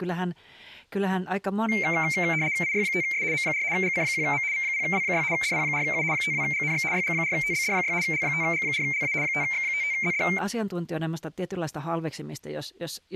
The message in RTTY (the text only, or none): IY5S M4 GC1M V0W6 DP4U 52GNX YG4TBD6 L5G4LA 5X55ZD